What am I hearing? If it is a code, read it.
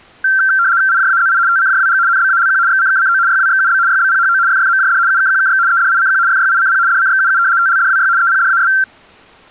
RTTY (75 baud, 170 Hz shift), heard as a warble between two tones, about 1460 Hz centre. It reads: IJAZI TCJWG NBALQ XCKCO YWXUB YBPHO FFMJD UKQKX EDICQ FYICP DCXUU TLDWY EPDAS